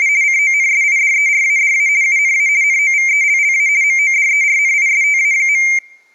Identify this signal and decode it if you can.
RTTY (50 baud, 170 Hz shift), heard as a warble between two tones, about 2200 Hz centre. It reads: … CONSIDERADA UNA NOVELLA MODERNISTA.